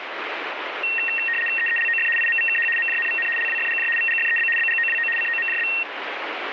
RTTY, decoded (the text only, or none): EELOF IMVKH MJNVN LWFGJ VGFEB BGOWO COMJB